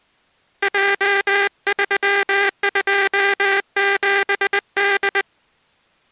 Morse code, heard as a buzzer, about 20 wpm. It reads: J327D